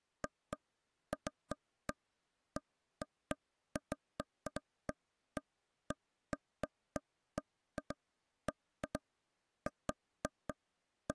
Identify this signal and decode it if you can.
Irregular taps on a table. There is no code.